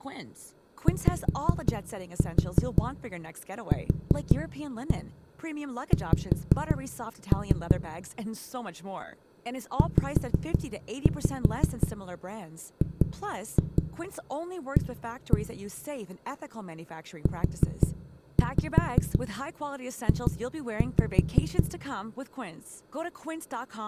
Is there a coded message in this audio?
Yes: tap code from 0.9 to 21.6 s, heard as knocks on a wall, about 5 knocks a second, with room echo and speech in Dutch. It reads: YQX ZGA UJ